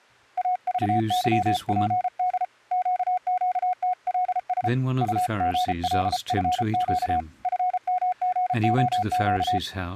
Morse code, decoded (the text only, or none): AVYPD QQTLS UGLFQ FMGOQ